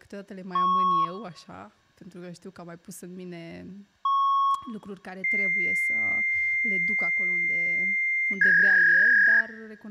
Fax machine handshake, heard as beeps, a long tone and a warble, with room echo and speech in Romanian.